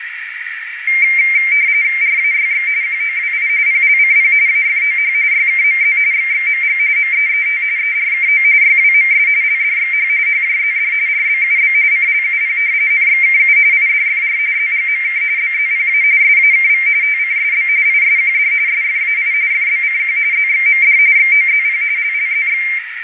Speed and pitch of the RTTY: 45.45 baud, 170 Hz shift, 2200 Hz centre

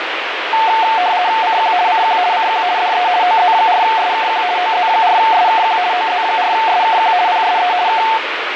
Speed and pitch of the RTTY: 50 baud, 170 Hz shift, 810 Hz centre

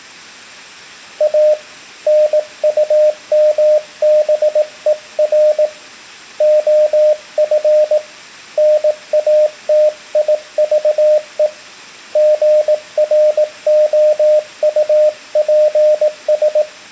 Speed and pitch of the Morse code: 18 wpm, 610 Hz

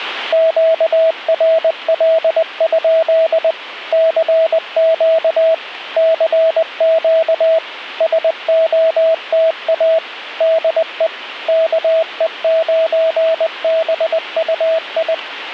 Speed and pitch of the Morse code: 20 wpm, 650 Hz

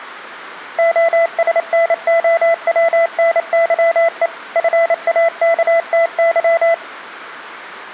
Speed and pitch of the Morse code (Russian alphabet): 28 wpm, 670 Hz

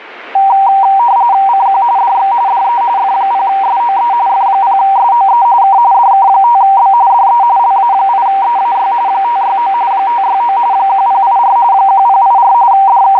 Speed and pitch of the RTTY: 45.45 baud, 170 Hz shift, 870 Hz centre

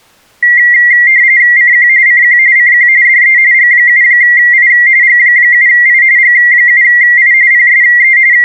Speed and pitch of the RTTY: 45.45 baud, 170 Hz shift, 2000 Hz centre

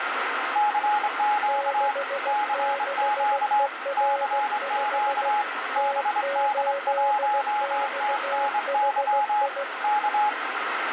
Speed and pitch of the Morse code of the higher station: 24 wpm, 840 Hz

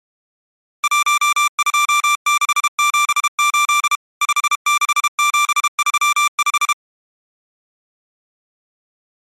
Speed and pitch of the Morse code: 32 wpm, 1180 Hz

